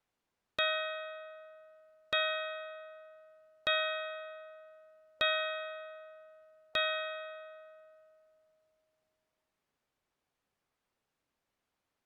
Clock strike, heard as a bell. 5. Five o'clock.